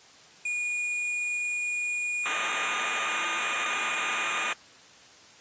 Cassette data (Kansas City type), 1200 baud, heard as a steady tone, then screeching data.